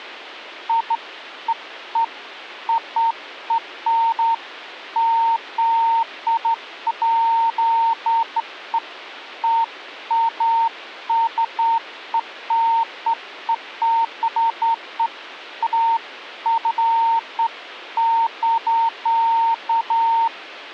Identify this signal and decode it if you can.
Beeps of irregular length. There is no code.